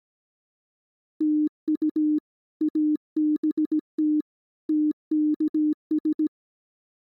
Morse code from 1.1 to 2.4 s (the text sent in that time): TU